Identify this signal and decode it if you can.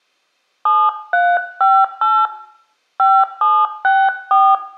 DTMF, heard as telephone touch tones, dialled by hand, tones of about 240 ms, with room echo. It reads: 7358 5764